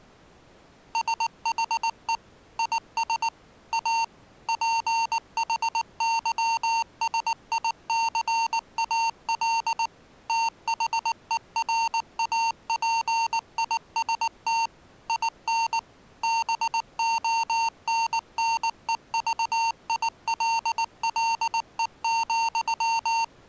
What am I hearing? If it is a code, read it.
Morse code, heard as electronic beeps, machine-sent, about 19 wpm, 910 Hz. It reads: SHE IS A PHYSICAL THERAPIST IN BONNEVILLE,